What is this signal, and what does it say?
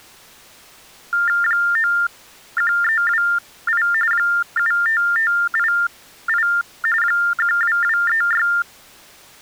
TTY/TDD text telephone tones (45.45 baud Baudot), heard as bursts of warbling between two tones, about 400 Hz shift, 1600 Hz centre. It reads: 91328 75588 12236